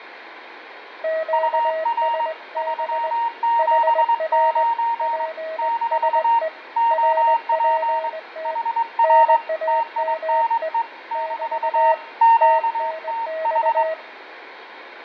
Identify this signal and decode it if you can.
Morse code, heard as two keyed tones, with radio static, fading and room echo. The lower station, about 20 wpm, 640 Hz: QSB HR PSE RPT NAME <BT> TNX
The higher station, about 22 wpm, 920 Hz: UR 379 - OP HR TINE - QTH